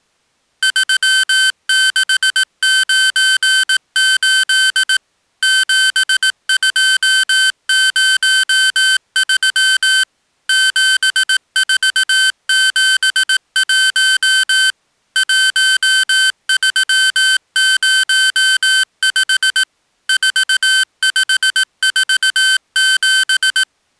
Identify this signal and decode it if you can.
Morse code, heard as electronic beeps, machine-sent, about 18 wpm, 1550 Hz. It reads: 3698 7203 7471 1305 4547